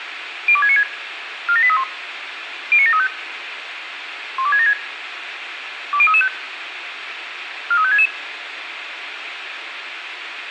Five-tone selective call (ZVEI), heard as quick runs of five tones, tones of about 70 ms, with radio hiss. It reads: 02696 47831 09735 12676 20335 43566